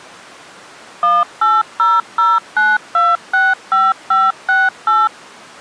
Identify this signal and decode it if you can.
DTMF, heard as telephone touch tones, dialled by machine, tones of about 200 ms. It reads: 18009265568